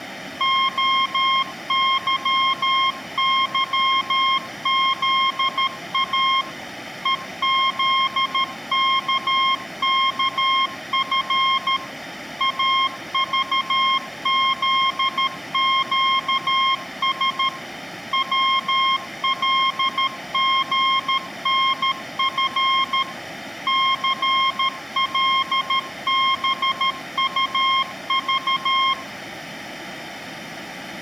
Morse code, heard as a keyed tone, machine-sent, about 13 wpm, 1070 Hz, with room echo. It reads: OYYZA EZKKF AVZQS WLGNF CLBUV